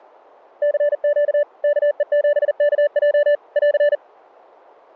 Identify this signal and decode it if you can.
Morse code, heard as a keyed tone, machine-sent, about 40 wpm, 580 Hz. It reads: CQ KE7KJ <AR>